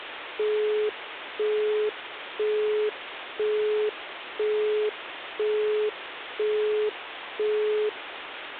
Telephone call progress tone (single-tone plan, as in Europe, Japan and elsewhere), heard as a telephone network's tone, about 420 Hz, 0.5 s on and 0.5 s off, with phone line noise. Busy tone.